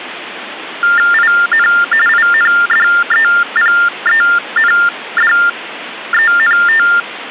TTY/TDD text telephone tones (45.45 baud Baudot), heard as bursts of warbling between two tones, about 400 Hz shift, 1600 Hz centre, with phone line noise. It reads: IN INDEPENDENT